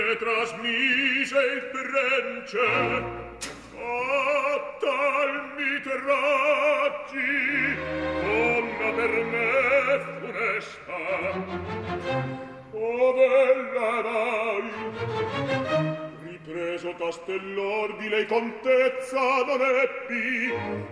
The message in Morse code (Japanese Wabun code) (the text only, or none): none